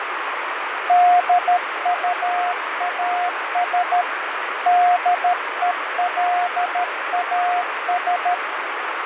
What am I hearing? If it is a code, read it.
Morse code, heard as a keyed tone, hand-sent with a paddle, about 13 wpm, 710 Hz, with radio static and fading. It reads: DUAS DELAS